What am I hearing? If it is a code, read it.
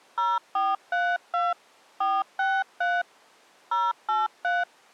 DTMF, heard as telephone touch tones, dialled by hand, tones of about 220 ms. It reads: 0432 463 083